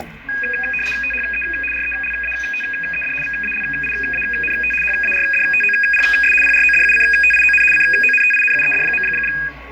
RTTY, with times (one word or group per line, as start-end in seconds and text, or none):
1.0-1.4 THE
1.7-3.1 RELATED
3.2-4.7 VALIANT
4.8-6.3 HARDTOPS
6.4-7.6 PRODUCTION
7.7-9.0 CONTINUED.